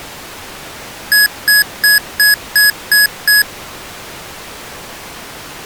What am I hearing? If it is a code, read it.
Beep code, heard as beeps from a small speaker, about 1700 Hz. 7 short. In AMI BIOS tables: virtual mode exception error; in Dell tables: processor failure.